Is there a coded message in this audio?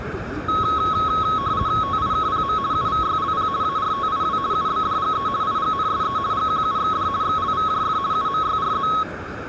Yes: RTTY (50 baud, 170 Hz shift) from 0.5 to 9.0 s, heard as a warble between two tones, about 1190 Hz centre, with radio static, a narrow filter and the noise of a park. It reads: TIKPM UVYLP ARTIW UBDGE IGNSE GQUXD XLVJF UMYRZ